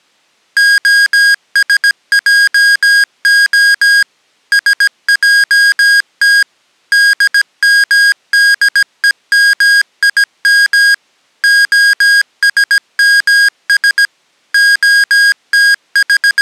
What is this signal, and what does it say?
Morse code (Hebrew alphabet), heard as electronic beeps, machine-sent, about 17 wpm, 1650 Hz. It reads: השעה שעת דמדומים השמש …